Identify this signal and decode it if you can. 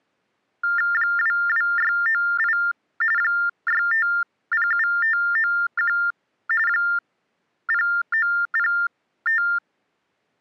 TTY/TDD text telephone tones (45.45 baud Baudot), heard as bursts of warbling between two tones, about 400 Hz shift, 1600 Hz centre. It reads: 22698 6507591 0905